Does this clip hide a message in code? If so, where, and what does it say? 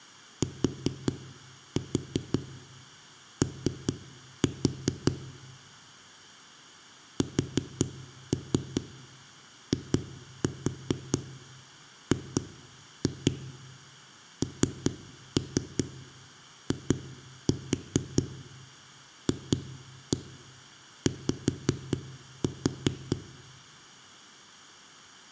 Yes: tap code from 0.4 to 23.2 s, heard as knocks on a wall, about 4 knocks a second, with room echo. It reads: TO SIGNIFY